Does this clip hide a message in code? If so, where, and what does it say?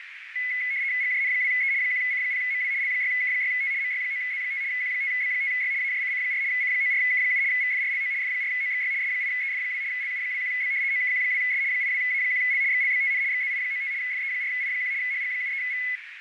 Yes: RTTY (75 baud, 170 Hz shift) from 0.4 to 16.0 s, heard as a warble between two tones, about 2100 Hz centre, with radio static and a narrow filter. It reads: GJN2E 1C0MW L6K6T MY9Z5 Q5B5Y AJCC4 C94K7 VFRLO F4OXY S8EF2 LU21B OKQ2S 82A1L XLBTN XZI95 FE4I1 HG73V